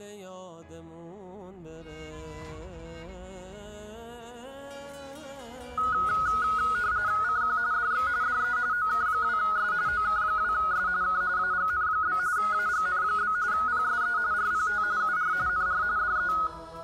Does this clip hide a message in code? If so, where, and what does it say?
Yes: RTTY (45.45 baud, 170 Hz shift) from 5.8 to 16.5 s, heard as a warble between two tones, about 1360 Hz centre. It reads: CQ DX DE OK2S OK2S K AGN? AGN? PSE RPT UR NR DE